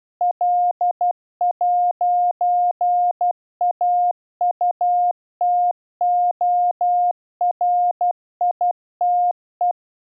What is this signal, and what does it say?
Morse code, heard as a keyed tone, machine-sent, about 12 wpm, 710 Hz. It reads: L'AUTORITE